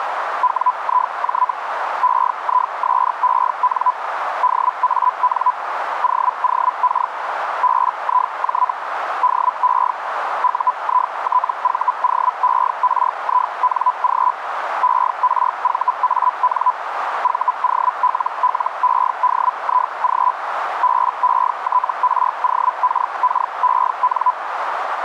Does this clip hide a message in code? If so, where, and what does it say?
Yes: Hellschreiber (Feld-Hell, 122.5 baud) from 0.4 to 24.3 s, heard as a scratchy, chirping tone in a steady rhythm, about 1000 Hz, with radio static and a narrow filter. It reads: WIJ EISEN DAN OOK BIJ DE UITVOERING ERVAN VOLLEDIG BETROKKEN